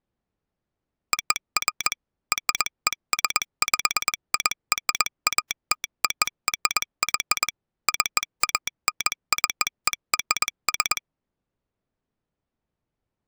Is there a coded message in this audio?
Yes: Morse code (American railroad code) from 1.1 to 11.0 s, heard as a telegraph sounder, machine-sent. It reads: OF RESPIRATORY CANCERS